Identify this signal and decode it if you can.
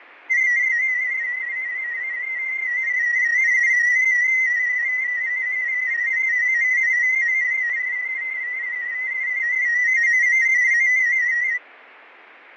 Multi-tone FSK (Olivia or MFSK type), about 250 Hz wide, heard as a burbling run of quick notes, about 31.25 baud, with radio static and fading.